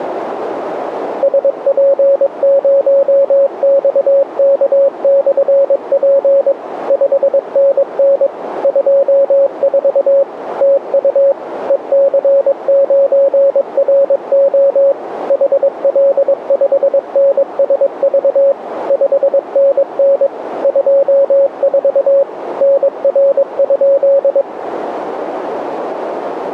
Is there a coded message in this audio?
Yes: Morse code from 1.2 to 24.5 s, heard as a keyed tone, machine-sent, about 22 wpm, 550 Hz, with radio static and a narrow filter. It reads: SP0XK/P 5NN 24 TU EC9RO HL5NSV 5NN 24 NR?